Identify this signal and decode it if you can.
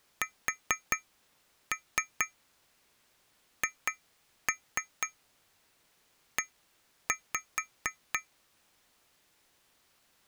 Tap code, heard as taps on glass, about 4 knocks a second. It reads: SHE